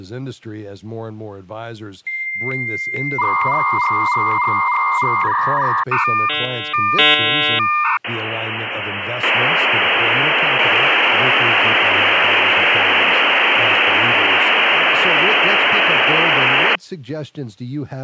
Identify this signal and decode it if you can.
Dial-up modem handshake (V.34 or later), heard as a whistle, warbles, then hiss, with speech in English.